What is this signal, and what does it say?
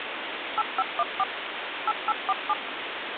DTMF, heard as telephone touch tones, dialled by machine, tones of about 40 ms, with phone line noise. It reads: 8514 8847